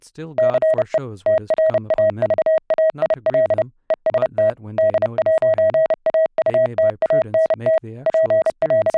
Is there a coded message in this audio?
Yes: Morse code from 0.3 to 9.0 s, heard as a keyed tone, machine-sent, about 30 wpm, 640 Hz, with speech in English. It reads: CE TRAVAIL EST D'AUTANT …